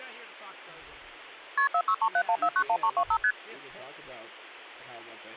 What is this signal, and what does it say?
Multi-frequency trunk signalling (R1, as on North American trunks), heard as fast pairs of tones, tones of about 70 ms, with hum and speech in English. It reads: KP 46371491325 ST